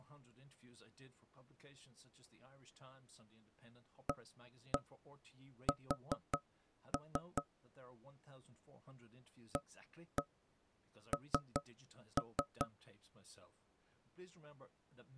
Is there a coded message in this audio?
Yes: tap code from 4.1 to 12.7 s, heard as knocks on wood, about 5 knocks a second, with speech in English. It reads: AS AN